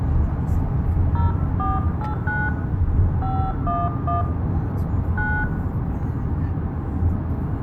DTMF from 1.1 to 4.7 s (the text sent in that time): 0489 511